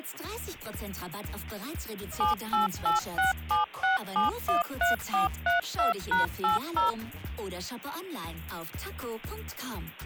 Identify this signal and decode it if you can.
DTMF, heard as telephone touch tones, dialled by machine, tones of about 140 ms. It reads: 788676713432#80